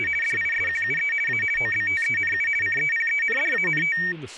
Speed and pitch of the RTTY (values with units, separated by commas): 50 baud, 450 Hz shift, 2050 Hz centre